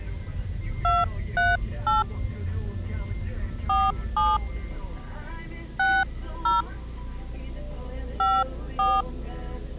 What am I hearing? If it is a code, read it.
DTMF, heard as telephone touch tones, dialled by hand, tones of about 190 ms, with the noise inside a car. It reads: 238 47 60 54